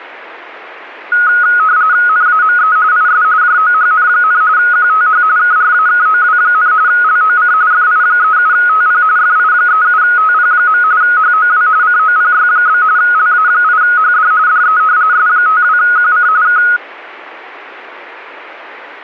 RTTY (45.45 baud, 170 Hz shift), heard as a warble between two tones, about 1360 Hz centre. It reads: NAME IS JOHN, QTH KRAKOW, LOC FI37TP FI37TP. HOW COPY? LA8HD DE S52QC K